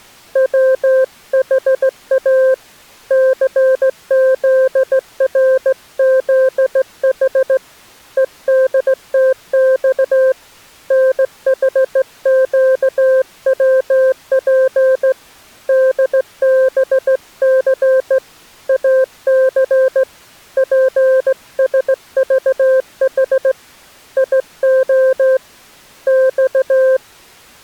Morse code, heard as a keyed tone, hand-sent with a straight key, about 16 wpm, 520 Hz. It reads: WHA CZRZH EDTX NHQWP DBC AC PSVH IO X